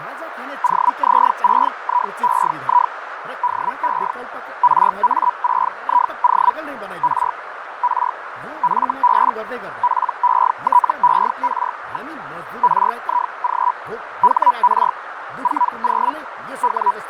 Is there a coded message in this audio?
Yes: Hellschreiber (Feld-Hell, 122.5 baud) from 0.6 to 17.1 s, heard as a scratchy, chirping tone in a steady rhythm, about 980 Hz, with radio static, fading, a narrow filter and speech in Nepali. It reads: OZ6IEI DE RA6IO R R FB PETER. RIG HR 40 …